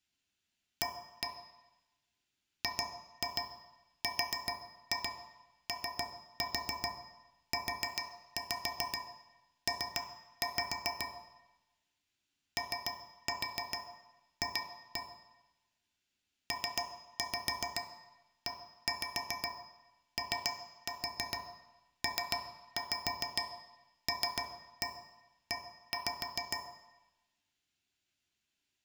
Tap code, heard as taps on a metal pipe, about 7 knocks a second, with room echo. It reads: A GROUP OF PEOPLE